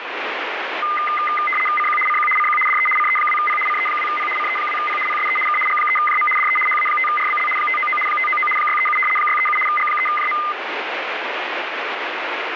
RTTY (75 baud, 850 Hz shift), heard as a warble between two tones, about 1650 Hz centre, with radio static. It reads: CQ CQ CQ DE CE2P CE2P CE2P PSE K G3JM DE HA5RBL 599 599 637 637 G3JM